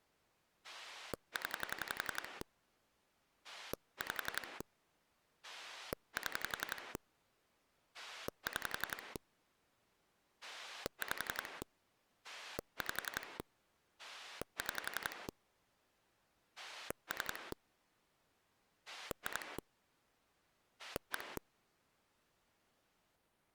Pulse dialling, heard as a rotary dial, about 11 pulses a second. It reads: 0 5 7 6 5 5 6 3 2 1